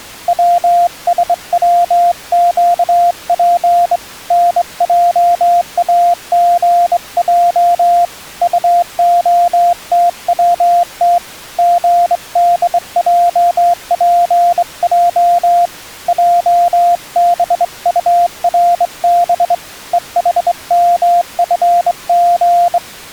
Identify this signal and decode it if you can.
Morse code, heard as a keyed tone, hand-sent with a straight key, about 23 wpm, 700 Hz. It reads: WSWQP NJAGJ UOTWT GDJPJ JBURB EHMFG